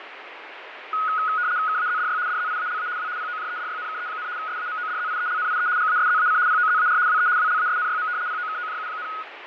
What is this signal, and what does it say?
RTTY (75 baud, 170 Hz shift), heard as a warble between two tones, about 1360 Hz centre, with radio static and fading. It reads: KAZDY DZIALA W POJEDYNKE, SAMODZIELNIE GASZAC POZAR WE WLASNYM POKOJU,